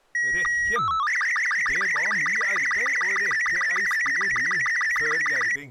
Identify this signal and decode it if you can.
SSTV (slow-scan television), Robot 36, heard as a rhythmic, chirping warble.